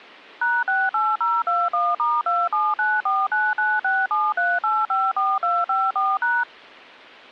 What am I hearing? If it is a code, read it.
DTMF, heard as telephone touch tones, dialled by machine, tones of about 220 ms. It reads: #68021*279499673854254#